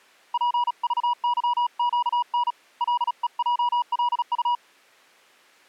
Morse code, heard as a keyed tone, hand-sent with a paddle, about 36 wpm, 970 Hz. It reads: PVYQN LEJLU